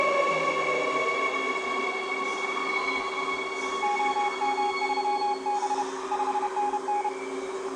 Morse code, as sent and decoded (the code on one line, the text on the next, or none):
--- -- ...-- -... / ..... -. -.
OM3B 5NN